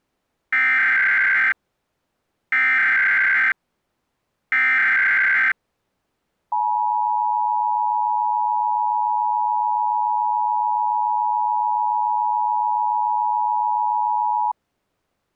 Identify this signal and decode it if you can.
Emergency Alert System (SAME) tones (header bursts, then the 853 and 960 Hz attention tone), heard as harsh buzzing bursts, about 520.83 baud.